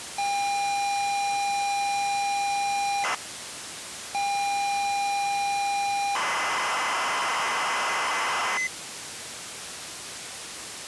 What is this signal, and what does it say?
ZX Spectrum tape loading, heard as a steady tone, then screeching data, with tape hiss.